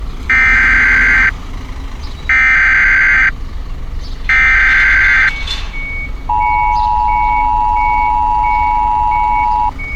Emergency Alert System (SAME) tones (header bursts, then the 853 and 960 Hz attention tone), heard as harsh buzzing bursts, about 520.83 baud, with street noise.